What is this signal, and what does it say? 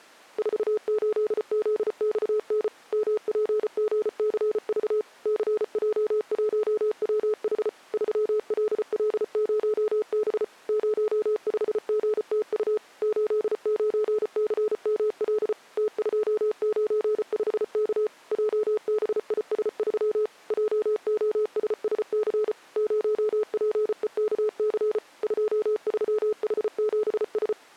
Morse code, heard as a keyed tone, machine-sent, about 34 wpm, 430 Hz. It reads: 48ZXN MPGCV CJ1WH 3LL0B 05GTU 89CML T295K JBIS3 JOSSC 0PEKC 23H7S